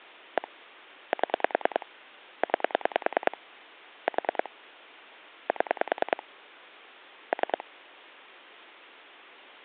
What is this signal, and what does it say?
Pulse dialling, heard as clicks on a phone line, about 10 pulses a second. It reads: 1 7 9 4 7 3